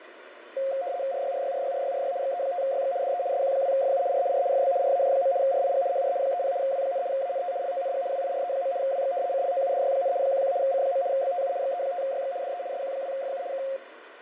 RTTY (75 baud, 170 Hz shift), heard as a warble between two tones, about 620 Hz centre, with radio static and fading. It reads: RYRYRYRYRY XE5YX DE SQ2FU R R FB RAJ. RIG HR 30 W, ANT LONG WIRE. WX CLOUDY, 11 C. BTU XE5YX DE SQ2FU K